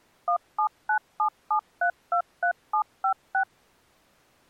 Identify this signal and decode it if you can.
DTMF, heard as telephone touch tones, dialled by machine, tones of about 90 ms. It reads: 17977323756